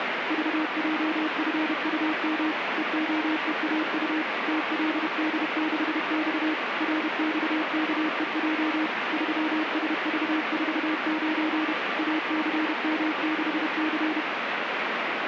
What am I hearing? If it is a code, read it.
Morse code, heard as a keyed tone, machine-sent, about 31 wpm, 310 Hz, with radio static. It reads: VJFUM EOEAU TLD6X RXKEJ 3SV49 ACM6C